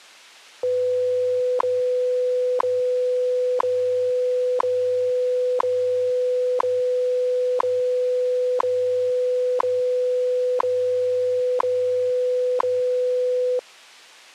Radio time signal (WWV, Colorado), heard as ticks, one a second.